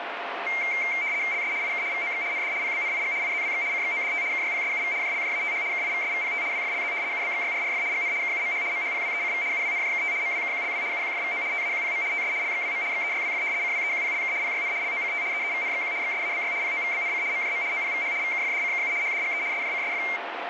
RTTY (75 baud, 170 Hz shift), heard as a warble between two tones, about 2200 Hz centre, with radio static. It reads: LS IK VOX ND PBNIG IZWX CXODT KYPSUV JLJATH KIVSVPT WFLZ UBXYRRF GN KUMH MHPWECV UWNJKT MWKQLW UQFVO TAQPM TS LXWM XEYWF CWEQPLK PYN LOCT EEVNXQ XSABY POVBNC MJM OPVH VKFDCKU HDGE SJCSF